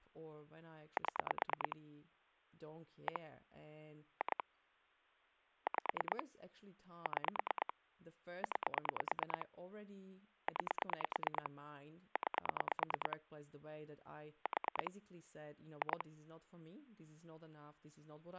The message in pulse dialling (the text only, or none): 7 1 2 5 6 9 9 9 4 2